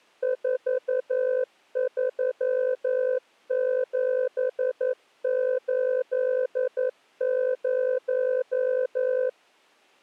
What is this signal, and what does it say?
Morse code, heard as a keyed tone, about 11 wpm, 510 Hz. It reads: 43780